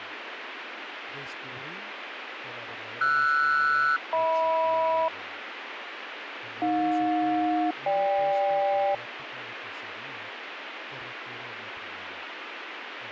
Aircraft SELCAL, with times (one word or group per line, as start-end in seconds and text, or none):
3.0-5.1 RS-HM
6.6-8.9 AJ-GK